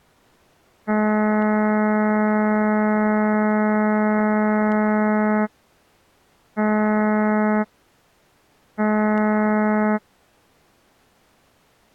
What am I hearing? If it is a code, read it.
Ship horn signal, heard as a ship's horn, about 210 Hz. 1 long, 2 short. At sea: a vessel in fog that is sailing, fishing, towing or hampered.